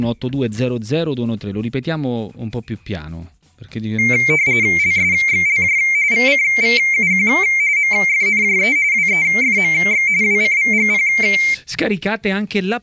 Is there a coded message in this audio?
Yes: RTTY (45.45 baud, 170 Hz shift) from 4.0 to 11.5 s, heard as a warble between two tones, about 2200 Hz centre. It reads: LSXLJ VCVUQ MFNJE WEFMX WCVGP